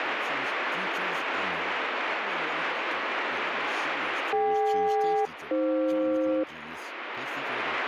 Aircraft SELCAL, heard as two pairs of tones, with radio static and speech in English. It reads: DK-AF